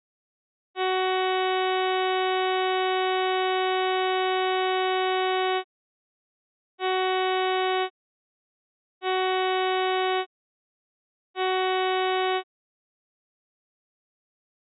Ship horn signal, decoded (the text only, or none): 1 long, 3 short